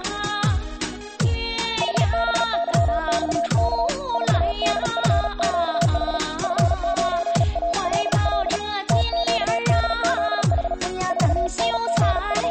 Morse code, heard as a keyed tone, hand-sent with a paddle, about 37 wpm, 680 Hz. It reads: HBYXK 4DFQH F9ALL TQDZH …